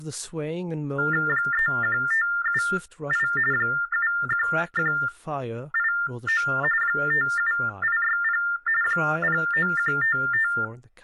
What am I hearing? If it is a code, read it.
TTY/TDD text telephone tones (45.45 baud Baudot), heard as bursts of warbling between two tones, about 400 Hz shift, 1600 Hz centre, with speech in English. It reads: 31578 71189 57860 09155